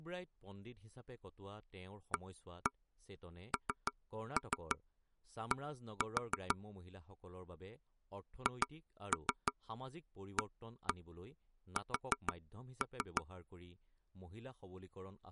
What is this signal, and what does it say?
Tap code, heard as taps on a table, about 6 knocks a second, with speech in Assamese. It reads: AND HAS